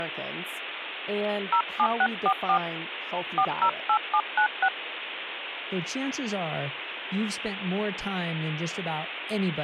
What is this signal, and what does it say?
DTMF, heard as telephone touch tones, dialled by hand, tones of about 70 ms, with phone line noise and speech in English. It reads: 07644 408796